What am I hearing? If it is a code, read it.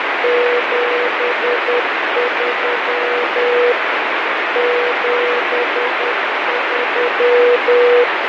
Morse code, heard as a keyed tone, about 10 wpm, 490 Hz, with heavy radio static and fading. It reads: 73 73